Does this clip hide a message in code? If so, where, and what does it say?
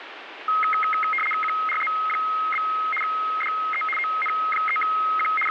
Yes: RTTY (75 baud, 850 Hz shift) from 0.5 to 5.5 s, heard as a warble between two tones, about 1700 Hz centre, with radio static. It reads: QRZ? DE ON3Q …